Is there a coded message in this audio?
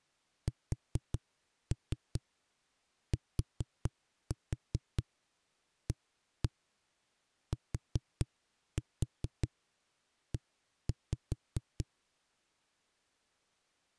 Yes: tap code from 0.5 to 11.9 s, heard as knocks on a wall, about 4 knocks a second. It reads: STATE